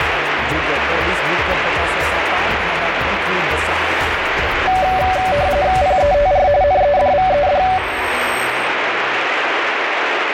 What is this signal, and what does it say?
RTTY (45.45 baud, 170 Hz shift), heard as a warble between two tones, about 660 Hz centre, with radio static. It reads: PETR NEDVED